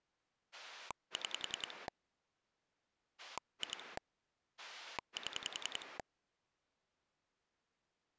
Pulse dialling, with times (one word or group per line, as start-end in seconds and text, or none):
0.5-1.9 6
3.2-4.0 2
4.6-6.0 7